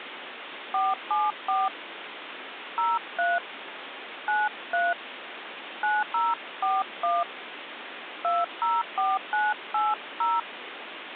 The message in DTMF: 474 03 93 9041 204980

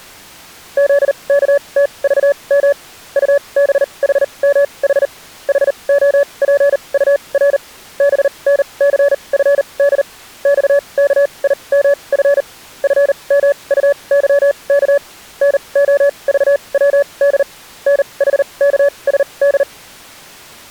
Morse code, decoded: ZKTVM UBHMH HOPUR BNCFD XKIMF FMUYK NOVWD NHKSD

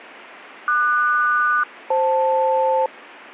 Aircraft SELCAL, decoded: QS-FL

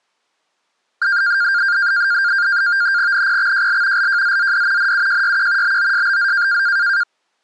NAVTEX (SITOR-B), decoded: NPXJL LJZZD NUJYQ BOSBZ

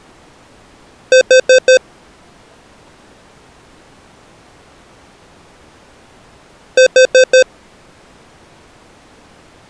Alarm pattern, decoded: temporal four

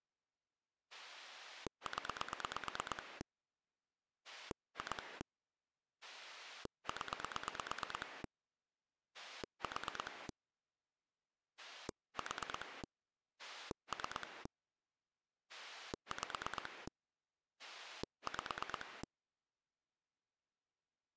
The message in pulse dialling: 0 2 0 4 4 3 5 5

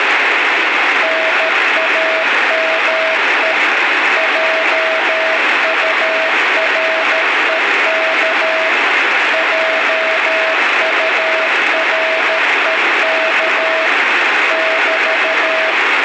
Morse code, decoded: NAME JUREK JUREK <BT>

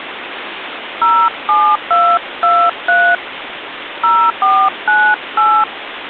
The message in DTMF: 07223 0498

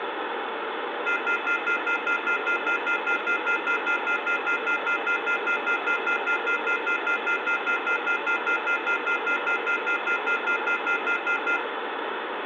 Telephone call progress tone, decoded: off-hook warning tone

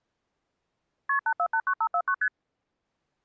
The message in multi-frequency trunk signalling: KP 8489549 ST

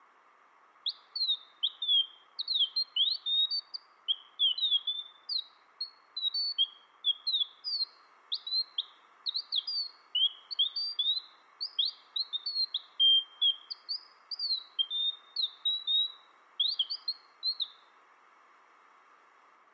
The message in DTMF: none

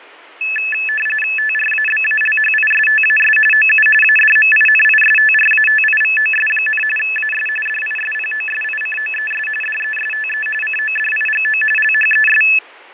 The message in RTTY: TRABALHISTAS OU ADMINISTRATIVOS, AS DISPOSICOES DESTE CODIGO LHES

